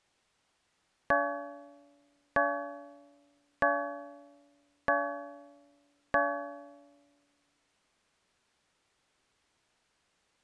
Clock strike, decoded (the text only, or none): 5